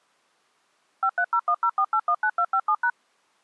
DTMF, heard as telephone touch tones, dialled by machine, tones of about 70 ms. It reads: 530104819257#